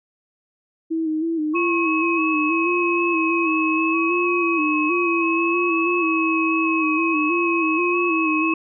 FT8 (several signals at once), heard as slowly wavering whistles, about 6.25 baud.